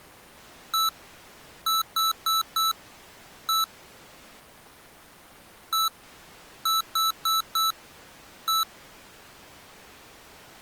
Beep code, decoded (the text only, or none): 1-4-1